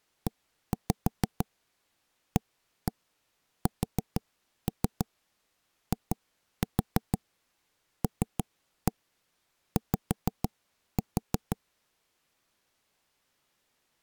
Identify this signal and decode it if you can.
Tap code, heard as knocks on wood, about 6 knocks a second. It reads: EASILY